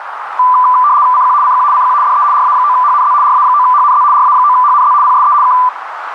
RTTY (75 baud, 170 Hz shift), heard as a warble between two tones, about 1090 Hz centre, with radio static and a narrow filter. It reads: CQ CQ CQ DE RA9HNZ RA9HNZ RA9HNZ PSE K